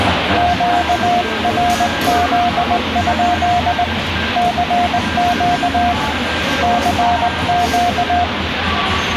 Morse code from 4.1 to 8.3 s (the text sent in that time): CQ CQ